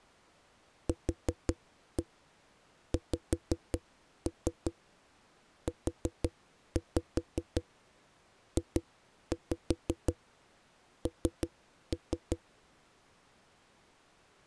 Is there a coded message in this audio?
Yes: tap code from 0.9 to 12.4 s, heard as knocks on a wall, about 5 knocks a second. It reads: QXUJN